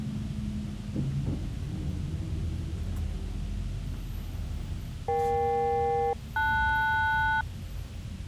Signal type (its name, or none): aircraft SELCAL